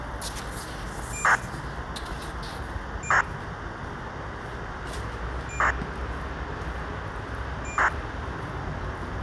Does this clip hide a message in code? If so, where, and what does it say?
Yes: ACARS aircraft data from 1.1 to 7.9 s, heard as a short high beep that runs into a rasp, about 2400 baud, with radio hiss and the noise of a residential street.